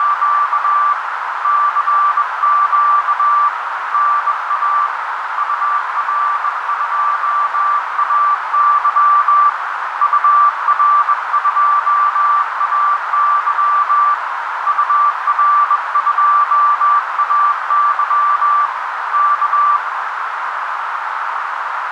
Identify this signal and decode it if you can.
Morse code, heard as a keyed tone, hand-sent with a bug key, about 21 wpm, 1170 Hz, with heavy radio static and a narrow filter. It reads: … CQ NA UR2AY UR2AY UR2AY K